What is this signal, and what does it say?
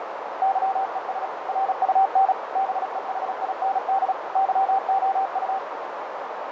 Morse code, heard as a keyed tone, machine-sent, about 36 wpm, 780 Hz, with heavy radio static, fading and a narrow filter. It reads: YES RUN BEHIND YOU